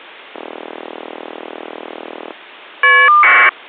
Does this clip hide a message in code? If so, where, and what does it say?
Yes: caller ID data burst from 0.3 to 3.5 s, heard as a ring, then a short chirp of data, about 1200 baud.